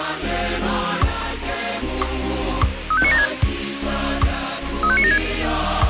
Five-tone selective call (ZVEI), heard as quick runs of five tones, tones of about 70 ms, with radio hiss. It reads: 35976 35976